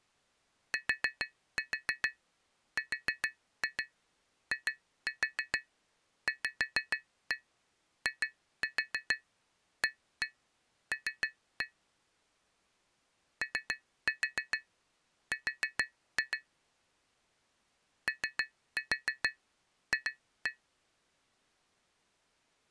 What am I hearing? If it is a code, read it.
Tap code, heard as taps on glass, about 6 knocks a second. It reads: TRIVIAL OR OF